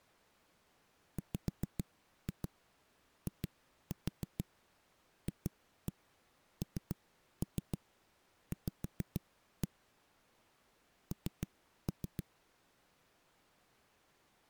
Tap code, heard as knocks on a wall, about 6 knocks a second. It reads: WIFNV N